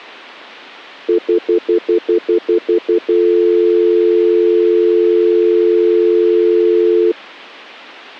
Telephone call progress tone (North American plan), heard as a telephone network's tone, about 350, 440 Hz, 0.1 s on and 0.1 s off. Stutter dial tone.